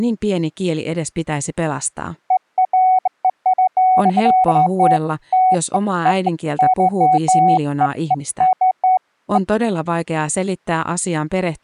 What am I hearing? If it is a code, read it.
Beeps of irregular length, with speech in Finnish. There is no code.